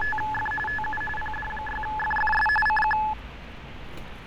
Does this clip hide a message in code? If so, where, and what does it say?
Yes: RTTY (45.45 baud, 850 Hz shift) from 0.0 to 3.1 s, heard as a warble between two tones, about 1290 Hz centre, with radio static, fading and street noise. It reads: … TU PD6FFS CQ